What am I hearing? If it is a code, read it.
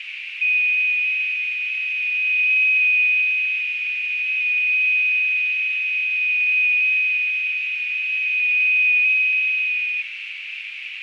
FT8 (one signal), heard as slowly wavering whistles, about 6.25 baud, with heavy radio static, fading and a narrow filter.